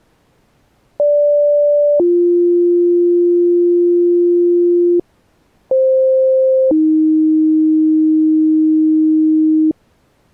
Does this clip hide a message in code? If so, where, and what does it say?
Yes: two-tone page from 1.0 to 9.7 s, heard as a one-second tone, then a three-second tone, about 580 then 350 Hz, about 520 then 310 Hz.